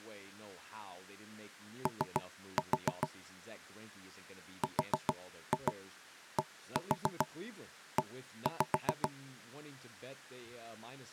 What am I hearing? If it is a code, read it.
Tap code, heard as knocks on wood, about 7 knocks a second, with speech in English. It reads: O RDE